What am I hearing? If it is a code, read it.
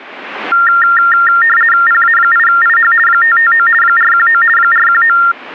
RTTY (50 baud, 450 Hz shift), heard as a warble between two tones, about 1600 Hz centre. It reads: PA8IH 559 419 419